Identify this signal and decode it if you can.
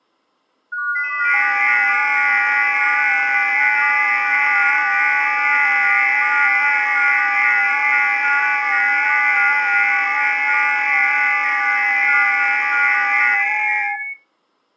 FT8 (several signals at once), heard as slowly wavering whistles, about 6.25 baud.